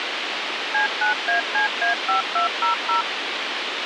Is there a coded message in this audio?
Yes: DTMF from 0.7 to 3.0 s, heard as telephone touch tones, dialled by machine, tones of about 120 ms, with radio hiss. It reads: C9ACA5200